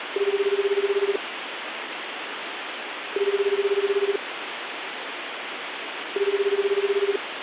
Telephone call progress tone (Japanese plan), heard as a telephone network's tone, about 380, 400, 420 Hz, 1 s on and 2 s off, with phone line noise. Ringback tone.